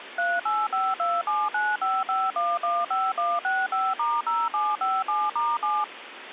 DTMF, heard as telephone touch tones, dialled by machine, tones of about 220 ms, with phone line noise. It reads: 38527955115165*0757*7